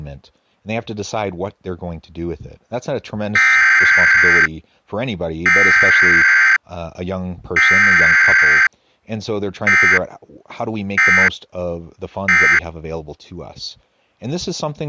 Emergency Alert System (SAME) tones (header bursts, then end-of-message bursts), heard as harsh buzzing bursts, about 520.83 baud, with speech in English.